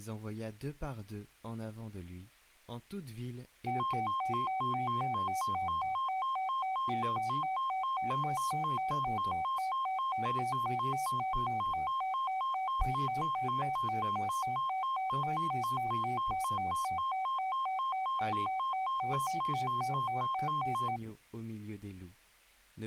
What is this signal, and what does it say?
A tone that alternates evenly between two pitches, with speech in French. There is no code.